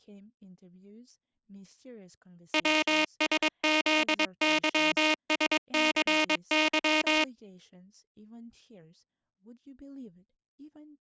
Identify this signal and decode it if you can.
Morse code, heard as a buzzer, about 22 wpm, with speech in English. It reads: WSZYSCY